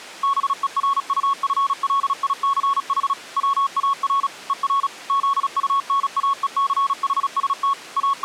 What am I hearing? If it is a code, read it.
Morse code, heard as a keyed tone, machine-sent, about 36 wpm, 1110 Hz. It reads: BERUFLICH WAR ER ZUNAECHST …